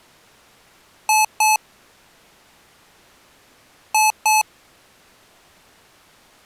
Beep code, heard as beeps from a small speaker, played twice, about 860 Hz. 2 short. In AMI BIOS tables: memory parity error; in IBM BIOS tables: self-test error shown on screen; in Dell tables: no memory detected.